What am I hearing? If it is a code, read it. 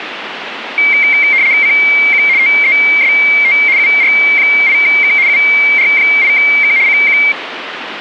RTTY (75 baud, 170 Hz shift), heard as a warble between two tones, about 2200 Hz centre, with radio static. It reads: CQ TEST UR8K UR8K CQ